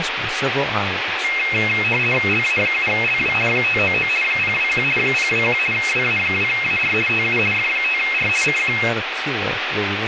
RTTY (50 baud, 450 Hz shift), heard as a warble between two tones, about 2350 Hz centre, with radio static and speech in English. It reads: LA7LW 599 021 021 WA2AR TU F5R CQ